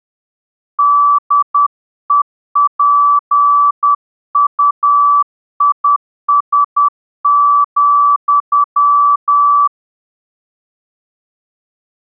Morse code, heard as a keyed tone, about 10 wpm, 1160 Hz. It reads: DEPUIS,